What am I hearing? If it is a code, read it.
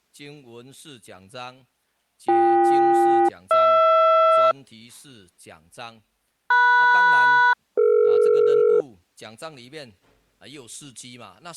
Aircraft SELCAL, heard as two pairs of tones. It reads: BK-HR MS-DE